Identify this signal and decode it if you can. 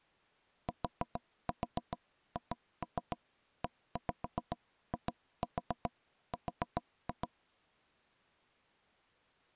Tap code, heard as knocks on wood, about 7 knocks a second. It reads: THEIR